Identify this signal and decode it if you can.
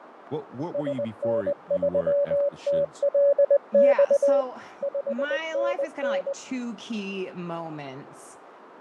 Morse code, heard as a keyed tone, machine-sent, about 20 wpm, 560 Hz, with radio static, fading and speech in English. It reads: SN3TLX 5NN